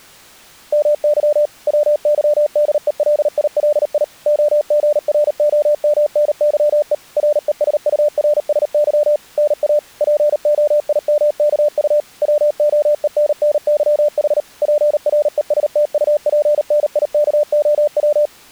Morse code (Russian alphabet), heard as a keyed tone, machine-sent, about 38 wpm, 590 Hz. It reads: МЫ ВЫДЕЛИЛИ ОГРОМНЫЕ РЕСУРСЫ НА ПОИМКУ ВОЕННЫХ ПРЕСТУПНИКОВ